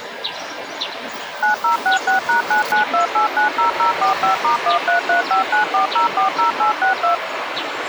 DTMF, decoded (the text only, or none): 9066#992890045*133594040862